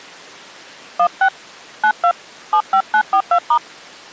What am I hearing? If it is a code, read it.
DTMF, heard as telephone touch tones, dialled by hand, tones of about 80 ms. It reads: 16 92 75942*